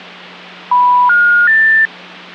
Telephone call progress tone (North American plan), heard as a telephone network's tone, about 980, 1430, 1800 Hz, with hum. Special information tone.